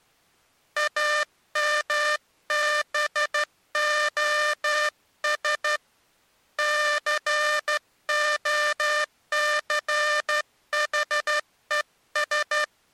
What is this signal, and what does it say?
Morse code, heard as a buzzer, hand-sent with a straight key, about 12 wpm. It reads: AMBOS COCHES